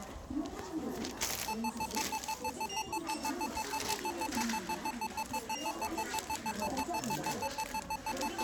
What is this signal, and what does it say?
Evenly repeated beeps, with the noise of a crowd indoors. There is no code.